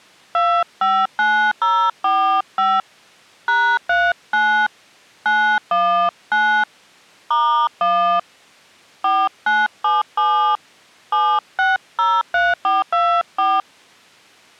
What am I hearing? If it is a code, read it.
DTMF, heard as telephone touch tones, dialled by hand, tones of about 280 ms. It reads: 259045 #39 919 *1 4977 7603424